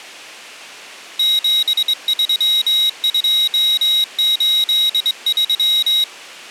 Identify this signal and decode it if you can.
Morse code, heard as a high beeper, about 23 wpm, 3800 Hz. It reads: 73283